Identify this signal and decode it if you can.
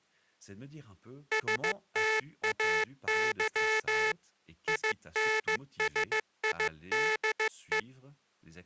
Morse code, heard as a buzzer, machine-sent, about 15 wpm, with speech in French. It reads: STAY INSIDE